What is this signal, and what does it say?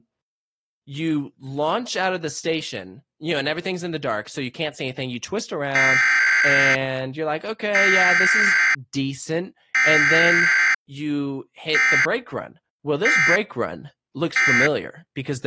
Emergency Alert System (SAME) tones (header bursts, then end-of-message bursts), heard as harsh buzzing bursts, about 520.83 baud, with speech in English.